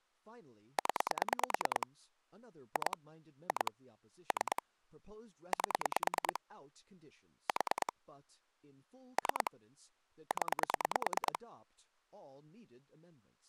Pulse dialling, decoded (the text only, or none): 0 2 2 3 8 4 3 0